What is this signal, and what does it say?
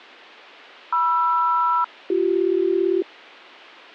Aircraft SELCAL, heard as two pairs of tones. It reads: MR-BC